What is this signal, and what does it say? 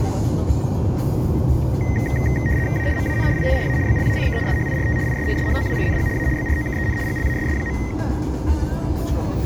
RTTY (75 baud, 170 Hz shift), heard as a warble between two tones, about 1950 Hz centre, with room echo and the noise inside a car. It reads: A MAN IN A BLACK SHIRT IS SHOWING A BROKEN GLASS.